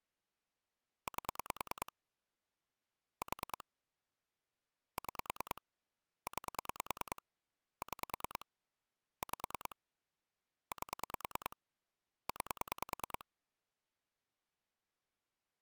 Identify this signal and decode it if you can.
Pulse dialling, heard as clicks on a phone line, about 9 pulses a second. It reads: 8 4 6 9 6 5 8 9